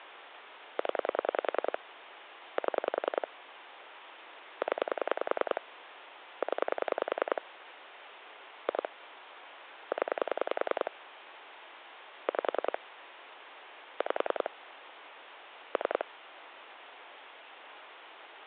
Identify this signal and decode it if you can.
Pulse dialling, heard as clicks on a phone line, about 10 pulses a second, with phone line noise. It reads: 0 7 0 0 2 0 5 5 3